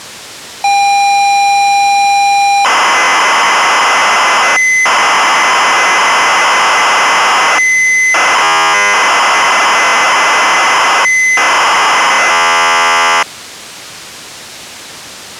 ZX Spectrum tape loading, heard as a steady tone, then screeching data.